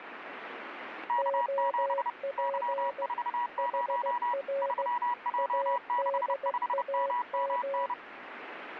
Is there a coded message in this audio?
Yes: Morse code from 1.0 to 8.0 s, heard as two keyed tones, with radio static. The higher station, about 30 wpm, 970 Hz: K7 Y40 3J65MMN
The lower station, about 16 wpm, 550 Hz: OP HR ADAM